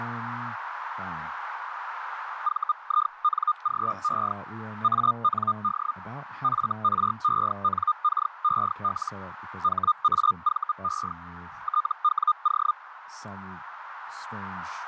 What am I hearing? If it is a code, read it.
Hellschreiber (Feld-Hell, 122.5 baud), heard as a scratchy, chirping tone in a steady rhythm, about 1220 Hz, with radio static, a narrow filter and speech in English. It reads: VINGE AND FRENKEL HAVE TWO